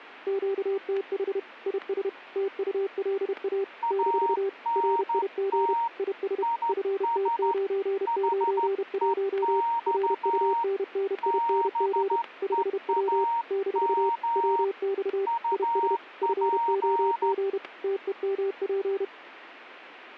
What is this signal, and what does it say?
Morse code, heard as two keyed tones, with static crashes. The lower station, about 31 wpm, 390 Hz: QTH IS TULA - RIG IS FT991 RUNNING 5W - WX IS FOG TEMP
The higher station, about 13 wpm, 930 Hz: ANT IS HEX BEAM UP